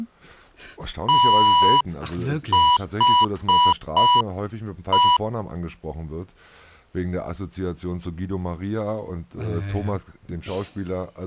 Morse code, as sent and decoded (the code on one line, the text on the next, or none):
- .... .
THE